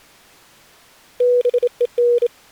Morse code, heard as a keyed tone, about 27 wpm, 480 Hz. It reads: BEN